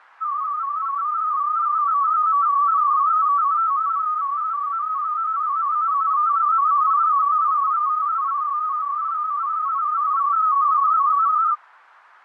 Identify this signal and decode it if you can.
Multi-tone FSK (Olivia or MFSK type), about 250 Hz wide, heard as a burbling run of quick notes, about 31.25 baud.